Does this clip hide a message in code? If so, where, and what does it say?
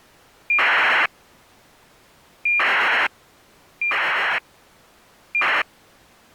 Yes: ACARS aircraft data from 0.5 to 5.6 s, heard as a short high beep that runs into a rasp, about 2400 baud.